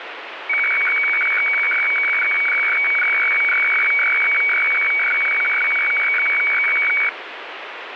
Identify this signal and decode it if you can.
Weather fax (radiofax), 120 lines a minute, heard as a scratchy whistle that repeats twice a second, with radio static.